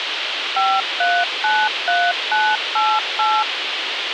DTMF, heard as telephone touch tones, dialled by machine, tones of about 240 ms, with radio hiss. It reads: 5393988